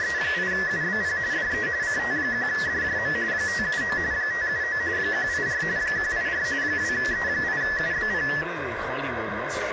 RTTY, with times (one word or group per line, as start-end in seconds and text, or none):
0.0-1.2 …
1.3-1.7 DE
1.8-3.1 CT1DJM
3.3-4.0 579
4.1-4.8 579
5.0-5.6 184
5.8-6.4 184
6.6-8.3 2E8UBP